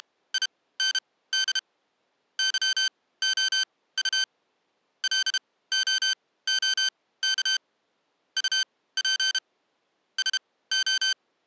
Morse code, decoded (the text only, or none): … YOU LOOK UP …